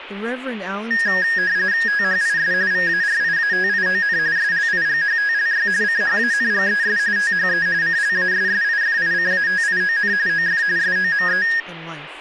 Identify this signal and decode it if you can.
RTTY (45.45 baud, 170 Hz shift), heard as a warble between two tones, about 1750 Hz centre, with speech in English. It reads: THIS VARIATION SLIGHTLY CHANGES THE CLASSIFICATION OF SOME